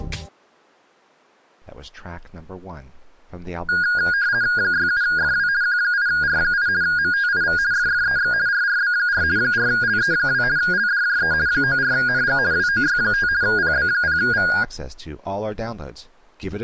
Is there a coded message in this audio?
Yes: RTTY (50 baud, 170 Hz shift) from 3.7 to 14.6 s, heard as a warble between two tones, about 1550 Hz centre. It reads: 67FW Q8R8 MTIV FFEX RRB4 4LE2 LDJE 94NG WOY5 PB0V